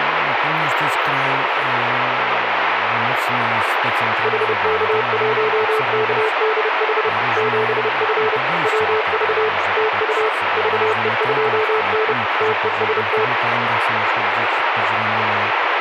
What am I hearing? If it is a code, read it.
Morse code, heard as a keyed tone, machine-sent, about 30 wpm, 440 Hz, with radio static and speech in Polish. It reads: HK1KDH 7F WV TU VE2N TEST